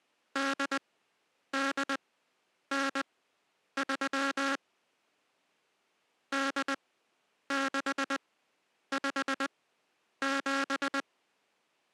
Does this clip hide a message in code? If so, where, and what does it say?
Yes: Morse code (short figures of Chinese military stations) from 0.3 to 11.1 s, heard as a buzzer, machine-sent, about 20 wpm, spaced as for 9 wpm. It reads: 8893 8657